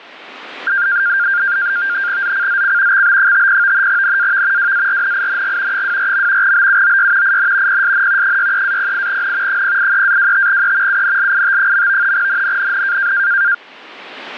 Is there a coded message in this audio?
Yes: NAVTEX (SITOR-B), 100 baud, 170 Hz shift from 0.7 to 13.5 s, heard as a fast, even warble, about 1500 Hz centre. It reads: ZCZC XB50 NAV WARNING 24. BUOY IN PSN 63-08N 083-25E UNLIT. NNNN